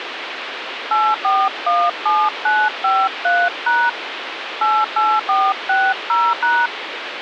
DTMF, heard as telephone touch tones, dialled by hand, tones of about 240 ms, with phone line noise. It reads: 8417953# 88460#